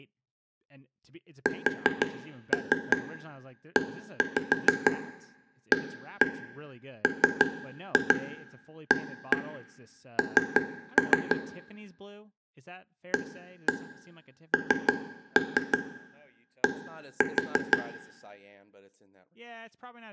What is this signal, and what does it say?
Tap code, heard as taps on a table, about 6 knocks a second, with room echo and speech in English. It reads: SEAMAN AND